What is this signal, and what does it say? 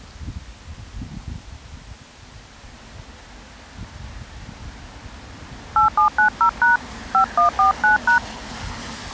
DTMF, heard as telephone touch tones, dialled by hand, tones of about 120 ms, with street noise. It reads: 8790# 5149#